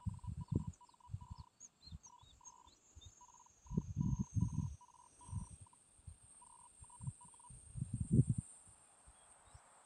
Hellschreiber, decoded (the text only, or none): NAME IS PIERRE, QTH